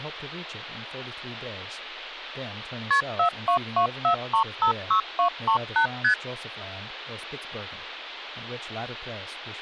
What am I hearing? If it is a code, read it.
Multi-frequency trunk signalling (R1, as on North American trunks), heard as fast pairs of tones, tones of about 100 ms, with speech in English. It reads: KP 4224356238 ST